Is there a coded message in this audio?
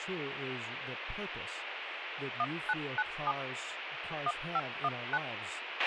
Yes: DTMF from 2.4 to 5.2 s, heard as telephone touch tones, dialled by machine, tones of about 50 ms, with radio hiss, a squelch burst at the end and speech in English. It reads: 1997 1519